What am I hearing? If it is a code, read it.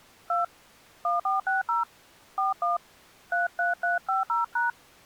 DTMF, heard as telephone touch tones, dialled by hand, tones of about 150 ms. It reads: 2 1460 41 33350#